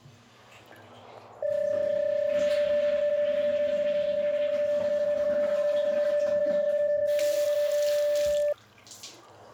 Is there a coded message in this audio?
Yes: PSK31 (31.25 baud) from 1.4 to 8.5 s, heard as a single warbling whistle, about 590 Hz, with static crashes and the noise of a restroom.